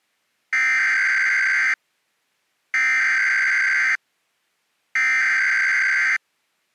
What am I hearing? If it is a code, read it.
Emergency Alert System (SAME) tones (header bursts), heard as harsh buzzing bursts, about 520.83 baud.